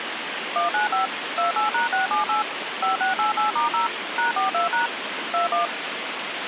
DTMF, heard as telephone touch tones, dialled by machine, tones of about 130 ms, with phone line noise. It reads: 195 28#678 5688*0 #42# 21